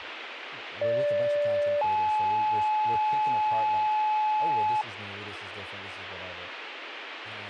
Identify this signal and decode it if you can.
Two-tone page, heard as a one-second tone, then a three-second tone, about 580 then 860 Hz, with radio hiss and speech in English.